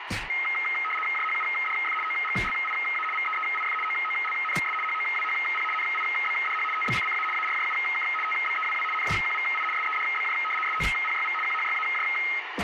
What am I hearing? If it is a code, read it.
RTTY (75 baud, 850 Hz shift), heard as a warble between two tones, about 1700 Hz centre, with radio static. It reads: JHUDF OGLIA VEEIF OOLNS HOWHP NIBDH TBCCA ARJUK TBEWW NJQVI SEDBJ SOPYV QHYAJ